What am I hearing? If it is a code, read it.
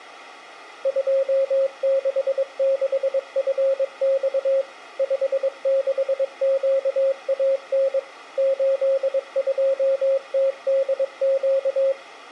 Morse code, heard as a keyed tone, machine-sent, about 22 wpm, 540 Hz. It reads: 266FX 56QAN 82TDQ